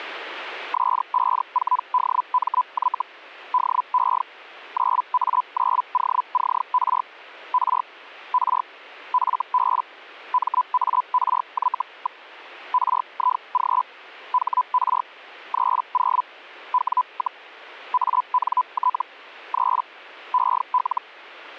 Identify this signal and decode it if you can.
Hellschreiber (Feld-Hell, 122.5 baud), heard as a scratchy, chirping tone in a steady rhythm, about 1000 Hz. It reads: S54DMY DE 9A9OCR R R FB MARY. RIG HR 30 W, ANT 3 EL